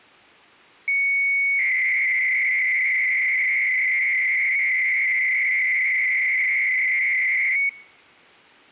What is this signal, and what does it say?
300-baud modem data (Bell 103 tones), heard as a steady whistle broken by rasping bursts, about 300 baud, 200 Hz shift.